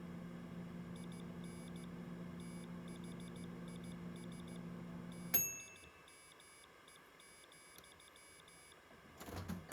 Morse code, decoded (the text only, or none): IN THIS TIME,